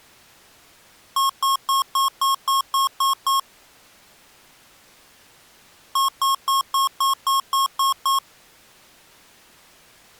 Beep code, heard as beeps from a small speaker, played twice, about 1080 Hz. 9 short. In AMI BIOS tables: ROM checksum failure.